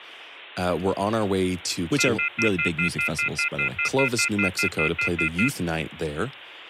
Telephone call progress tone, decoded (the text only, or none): off-hook warning tone